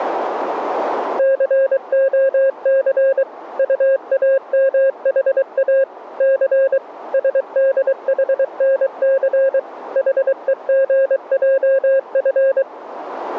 Morse code, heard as a keyed tone, machine-sent, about 23 wpm, 540 Hz. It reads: COC UAMHA C SDHNC HEGJF